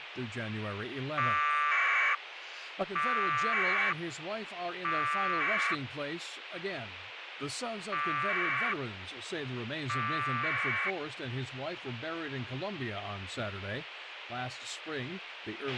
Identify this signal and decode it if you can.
Packet radio (AX.25, as in APRS), 1200 baud, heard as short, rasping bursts, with radio hiss, a squelch burst at the end and speech in English.